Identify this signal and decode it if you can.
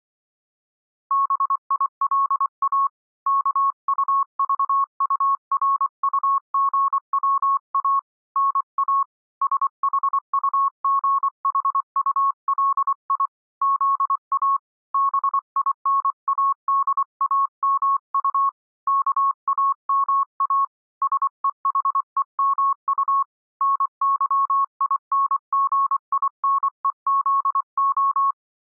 Morse code, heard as a keyed tone, hand-sent with a paddle, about 24 wpm, 1100 Hz. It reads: BILA KUVURUGWA NA SHUGHULI ZA BINADAMU KAMA SEHEMU NYINGINEZO